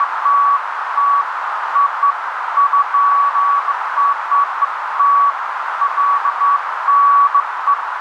Beeps of irregular length, with heavy radio static and a narrow filter. There is no code.